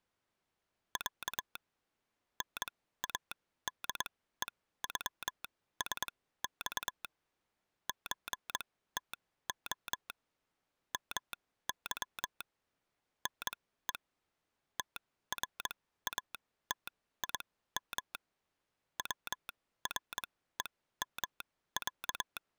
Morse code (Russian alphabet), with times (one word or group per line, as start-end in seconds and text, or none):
1.0-1.6 Я
2.4-7.0 НАДЕЮСЬ
7.9-10.1 ЧТО
10.9-12.4 МЫ
13.3-13.9 НЕ
14.8-18.1 ТРАТИМ
19.0-22.4 ВРЕМЯ